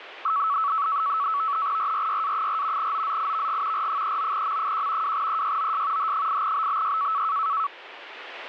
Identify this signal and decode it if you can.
NAVTEX (SITOR-B), 100 baud, 170 Hz shift, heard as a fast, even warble, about 1220 Hz centre, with radio static. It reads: RRYA4 OZIVG R39M1 2EYOS H8BBY